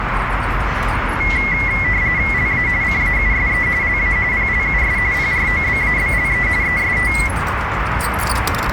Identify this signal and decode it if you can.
RTTY (45.45 baud, 170 Hz shift), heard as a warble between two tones, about 2050 Hz centre, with radio static and street noise. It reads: LA CAUSE LA PLUS PROBABLE EST